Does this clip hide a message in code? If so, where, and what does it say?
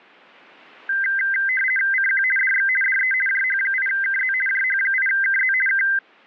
Yes: RTTY (50 baud, 450 Hz shift) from 0.9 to 6.0 s, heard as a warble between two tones, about 1800 Hz centre. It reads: CQ DX DE JH8KZ JH8KZ K